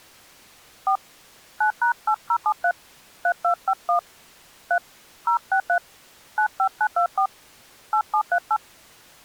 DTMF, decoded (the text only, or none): 4 9#8073 3251 3 063 95924 8738